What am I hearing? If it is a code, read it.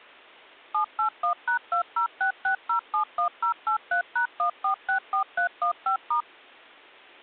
DTMF, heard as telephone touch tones, dialled by machine, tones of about 100 ms. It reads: 781#2066071083#1464315*